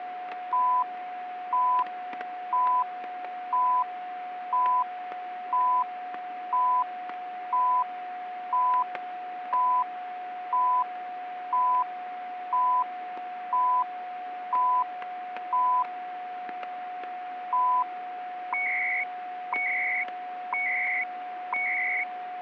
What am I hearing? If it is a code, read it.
Radio time signal (CHU, Canada), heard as beeps and data bursts, one a second, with static crashes and a steady whistle near 730 Hz.